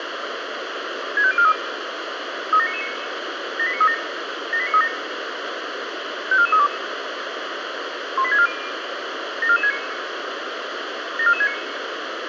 Five-tone selective call (ZVEI), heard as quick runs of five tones, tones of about 70 ms, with radio hiss. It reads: 65043 37999 78937 78937 54432 18640 74469 74469